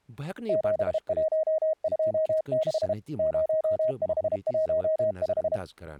Morse code, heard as a keyed tone, machine-sent, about 32 wpm, 630 Hz, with speech in Kashmiri. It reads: 7126 0515